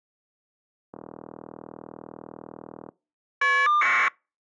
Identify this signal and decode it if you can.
Caller ID data burst, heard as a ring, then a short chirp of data, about 1200 baud.